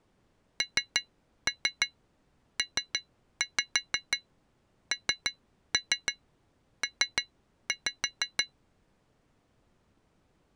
Tap code, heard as taps on glass, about 6 knocks a second. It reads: NPNP